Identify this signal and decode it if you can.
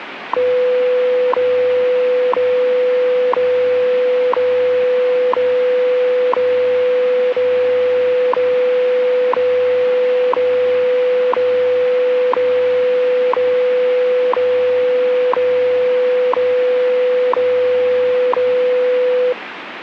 Radio time signal (WWV, Colorado), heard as ticks, one a second, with radio static.